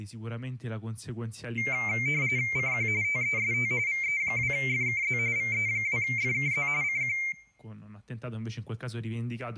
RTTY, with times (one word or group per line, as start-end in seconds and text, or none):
2.6-2.9 CQ
3.0-3.7 TEST
3.9-5.2 VE2FKZ
5.4-6.7 VE2FKZ
6.8-7.2 CQ